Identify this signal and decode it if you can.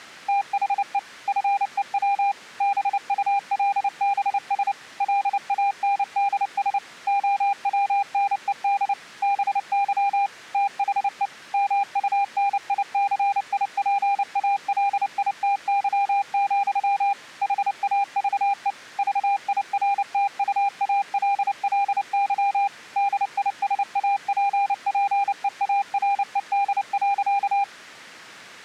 Morse code, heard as a keyed tone, machine-sent, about 29 wpm, 800 Hz. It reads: THE FEW BULBS LANDS OWNED BY THE MUNICIPALITY, HAVE VIRTUALLY DISAPPEARED.